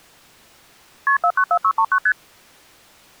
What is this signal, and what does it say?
Multi-frequency trunk signalling (R1, as on North American trunks), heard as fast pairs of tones, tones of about 70 ms. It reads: KP 494639 ST